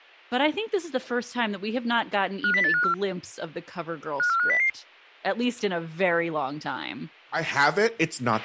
Five-tone selective call (CCIR), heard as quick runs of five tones, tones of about 100 ms, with a squelch burst at the end and speech in English. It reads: 50854 54500